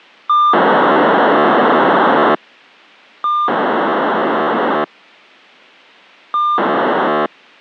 POCSAG pager data (2400 baud), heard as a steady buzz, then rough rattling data.